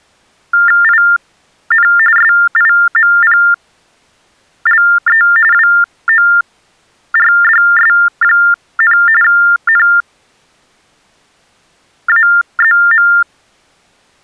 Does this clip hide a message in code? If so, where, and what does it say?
Yes: TTY/TDD text telephone tones (45.45 baud Baudot) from 0.5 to 13.2 s, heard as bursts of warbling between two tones, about 400 Hz shift, 1600 Hz centre. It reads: IN SIMPLE WORDS, NAZM